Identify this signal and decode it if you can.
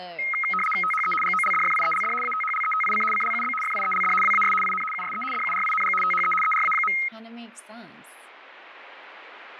RTTY (75 baud, 850 Hz shift), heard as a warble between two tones, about 1700 Hz centre, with speech in English. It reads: THE GOLDFIELD ATHLETIC CLUB FIELD WAS IN USE DURING THE ERA.